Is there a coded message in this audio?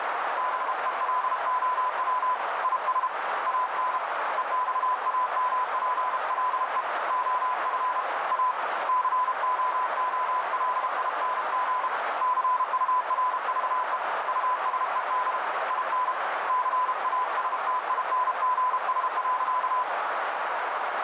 Yes: Morse code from 0.3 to 19.9 s, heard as a keyed tone, hand-sent with a paddle, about 32 wpm, 1000 Hz, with heavy radio static and a narrow filter. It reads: BELOW IS AN EXAMPLE OF A COOLING CURVE USED IN CASTINGS.